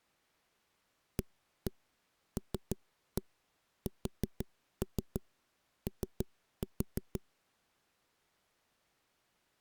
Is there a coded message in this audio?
Yes: tap code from 1.2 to 7.2 s, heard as knocks on a wall, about 6 knocks a second. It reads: ALSO